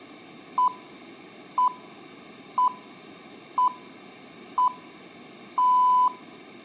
Radio time signal (six pips, as the Greenwich Time Signal), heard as pips, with room echo.